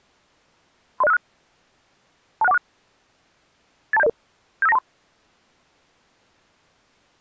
Five-tone selective call (EIA), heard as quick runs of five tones, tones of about 30 ms. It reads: 30656 26146 82700 75923